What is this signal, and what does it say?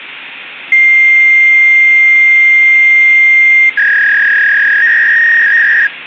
Fax machine handshake, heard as a long tone and a warble, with phone line noise.